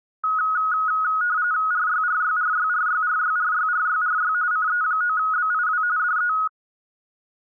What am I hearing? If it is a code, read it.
RTTY (45.45 baud, 170 Hz shift), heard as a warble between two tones, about 1360 Hz centre. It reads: RYRYRYRYRYRYRYRY CE9BIW DE